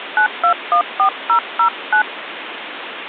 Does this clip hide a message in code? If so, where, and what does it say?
Yes: DTMF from 0.2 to 2.0 s, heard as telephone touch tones, dialled by hand, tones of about 90 ms, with phone line noise. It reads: 9214009